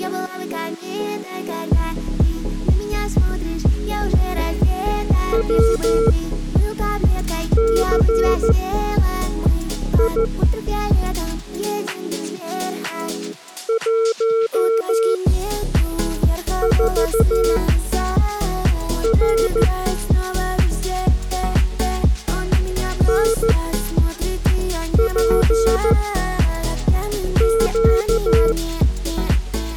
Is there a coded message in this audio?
Yes: Morse code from 5.3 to 28.6 s, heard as a keyed tone, machine-sent, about 14 wpm, spaced as for 5 wpm, 450 Hz. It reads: WCI 14R NPQ